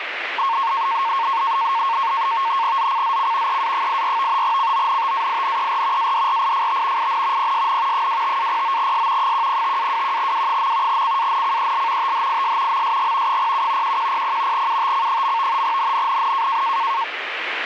NAVTEX (SITOR-B), 100 baud, 170 Hz shift, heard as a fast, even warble, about 1000 Hz centre, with radio static. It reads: ZCZC EA84 CONTAINER ADRIFT IN PSN 25-09S 105-21W. CANCEL THIS MSG 07 1100 UTC. NNNN